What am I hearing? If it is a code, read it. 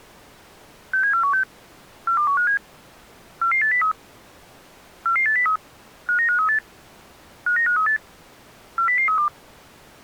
Five-tone selective call (CCIR), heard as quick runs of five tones, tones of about 100 ms. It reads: 67416 42157 44803 44803 59538 59538 40032